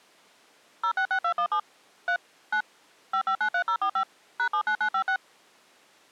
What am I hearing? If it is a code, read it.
DTMF, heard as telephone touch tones, dialled by machine, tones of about 80 ms. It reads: 066217 3 9 5593045 #79956